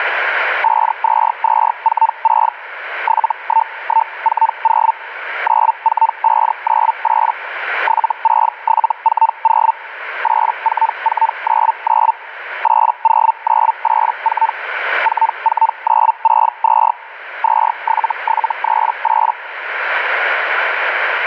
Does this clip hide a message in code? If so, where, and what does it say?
Yes: Hellschreiber (Feld-Hell, 122.5 baud) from 0.6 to 19.3 s, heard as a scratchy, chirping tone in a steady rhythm, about 900 Hz, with radio static. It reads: 52246 71140 94598 76740 84499 80984 44962 27738